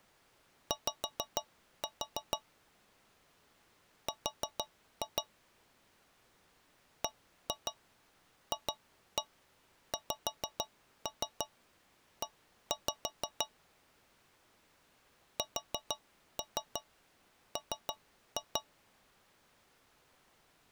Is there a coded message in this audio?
Yes: tap code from 0.7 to 18.7 s, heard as taps on a metal pipe, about 6 knocks a second. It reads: Y R BFXE SM